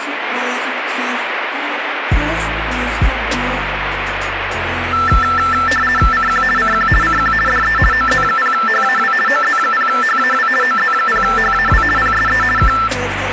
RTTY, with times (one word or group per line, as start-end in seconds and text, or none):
6.1-6.4 CQ
6.6-6.9 CQ
7.0-7.3 CQ
7.5-7.8 DE
7.9-9.1 OZ0HAW
9.3-10.5 OZ0HAW
10.6-11.8 OZ0HAW
12.0-12.4 PSE
12.6-12.7 K